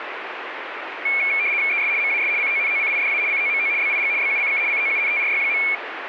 RTTY (75 baud, 170 Hz shift), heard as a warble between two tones, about 2300 Hz centre, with radio static. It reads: ES MAS CONOCIDA COMO BIG BUCK COUNTRY.